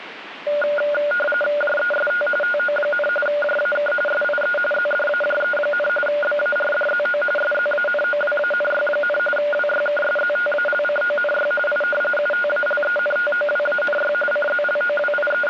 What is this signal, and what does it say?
RTTY (45.45 baud, 850 Hz shift), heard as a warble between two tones, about 1010 Hz centre, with radio static. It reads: JEST TO, JAK SIE ZDAJE, BARDZO SZANOWANY, WYKSZTALCONY I UTALENTOWANY …